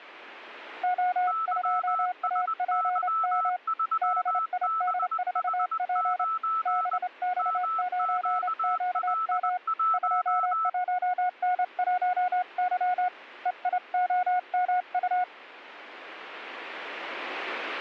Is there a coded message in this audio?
Yes: Morse code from 0.8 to 15.3 s, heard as two keyed tones. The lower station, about 28 wpm, 730 Hz: O2APM BID4P BX9QM 21N1Y EIOMU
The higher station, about 20 wpm, 1320 Hz: YSY3BH9 MQL1